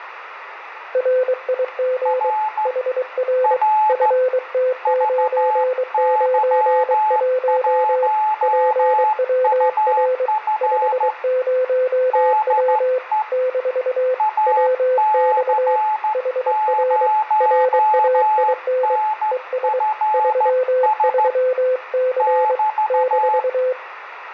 Morse code, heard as two keyed tones, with room echo. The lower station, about 23 wpm, 510 Hz: RIG HR FT991 PWR 50W - WX HR RAIN ES 33C -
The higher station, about 14 wpm, 860 Hz: R R VY1UF DE AC0NFS <BT>